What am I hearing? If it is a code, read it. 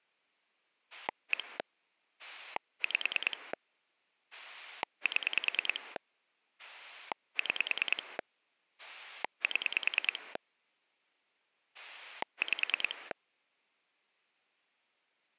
Pulse dialling, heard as a rotary dial, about 9 pulses a second. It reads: 1 5 7 6 7 5